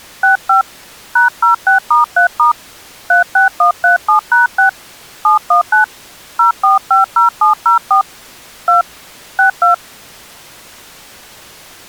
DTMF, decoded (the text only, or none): 65 #06*3* 36137#6 719 0450704 2 62